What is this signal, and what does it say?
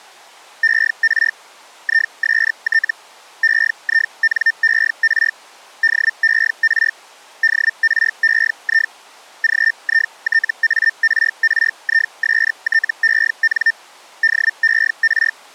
Hellschreiber (Feld-Hell, 122.5 baud), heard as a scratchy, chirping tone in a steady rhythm, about 1800 Hz. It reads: ER IST EINER DER DREI GITARRISTEN DER